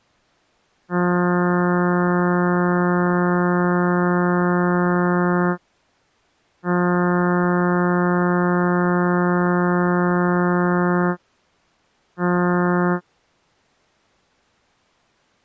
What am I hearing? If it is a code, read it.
Ship horn signal, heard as a ship's horn, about 180 Hz. 2 long, 1 short. At sea: I intend to overtake on your starboard side.